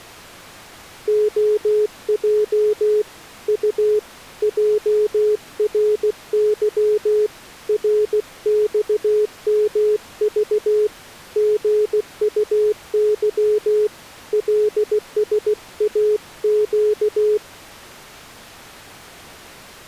Morse code, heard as a keyed tone, hand-sent with a paddle, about 16 wpm, 420 Hz. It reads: OJ U JRY RXMV GUY LSAQ